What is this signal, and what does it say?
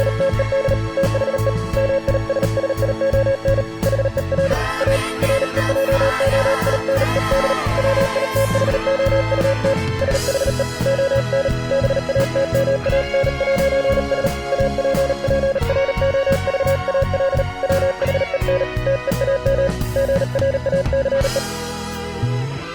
Morse code, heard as a keyed tone, hand-sent with a paddle, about 38 wpm, 540 Hz. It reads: … THE MISSION HER A REJOINED WITHOUT SHE ON BATMAN'S APPROVAL WHEN TEAM GRACE